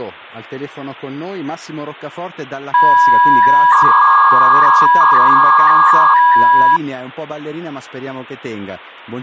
300-baud modem data (V.21 tones), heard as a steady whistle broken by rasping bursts, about 300 baud, 200 Hz shift.